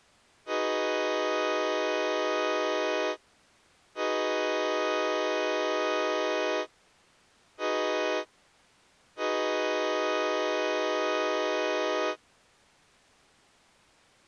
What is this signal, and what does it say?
Train horn signal, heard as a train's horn. 2 long, 1 short, 1 long. On North American railways: approaching a public crossing.